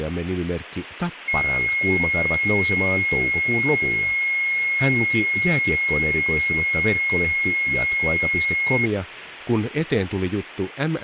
A steady tone, with hum and speech in Finnish. There is no code.